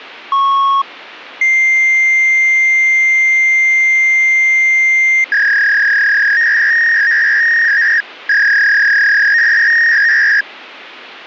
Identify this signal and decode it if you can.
Fax machine handshake, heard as a beep, a long tone and a warble, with phone line noise.